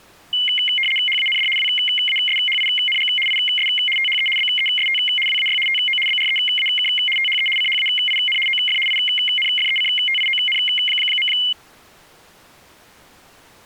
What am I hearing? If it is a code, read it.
RTTY (75 baud, 850 Hz shift), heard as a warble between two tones, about 2550 Hz centre. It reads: HAND WASHING IS THE BEST WAY TO BREAK THE CHAIN OF INFECTION.